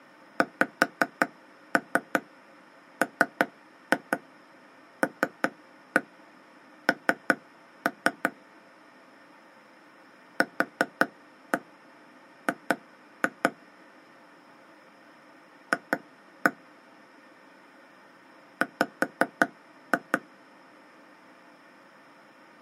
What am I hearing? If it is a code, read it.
Tap code, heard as taps on a table, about 5 knocks a second. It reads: XMLN QG F W